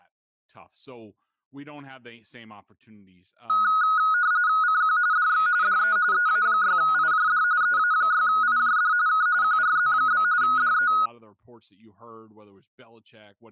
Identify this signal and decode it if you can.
RTTY (45.45 baud, 170 Hz shift), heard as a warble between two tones, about 1360 Hz centre, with speech in English. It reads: CQ DX DE EA6IJD EA6IJD K QRZ? DE